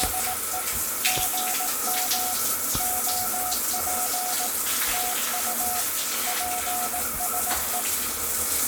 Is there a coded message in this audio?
Yes: Morse code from 0.0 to 7.9 s, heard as a keyed tone, machine-sent, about 18 wpm, 730 Hz, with the noise of a restroom. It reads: … GM OP TU PSE